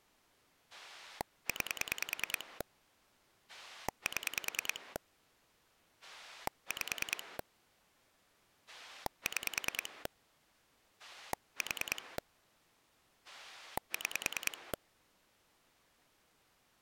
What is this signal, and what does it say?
Pulse dialling, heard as a rotary dial, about 10 pulses a second. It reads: 9 7 5 6 4 6